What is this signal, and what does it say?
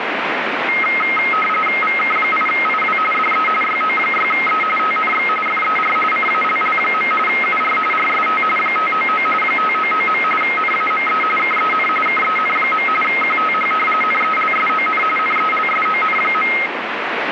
RTTY (45.45 baud, 850 Hz shift), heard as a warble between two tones, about 1700 Hz centre, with radio static. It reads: VK8IW DE YO6E TNX FER CALL. UR RST 599 599. NAME KEN KEN. QTH NELSON NELSON.